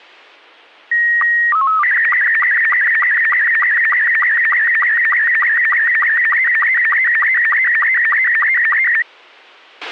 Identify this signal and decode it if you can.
SSTV (slow-scan television), Robot 72, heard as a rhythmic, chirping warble, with a squelch burst at the end.